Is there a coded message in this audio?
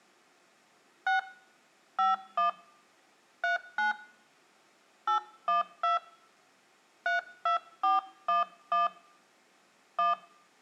Yes: DTMF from 1.1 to 10.1 s, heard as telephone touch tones, dialled by hand, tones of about 140 ms, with room echo. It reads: 6 51 39 812 32411 1